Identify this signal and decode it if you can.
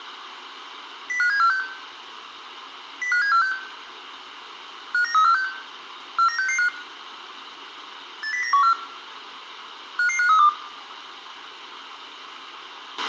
Five-tone selective call (CCIR), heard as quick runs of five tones, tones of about 100 ms, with a squelch burst at the end and room echo. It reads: 05746 05746 59346 49665 80914 55532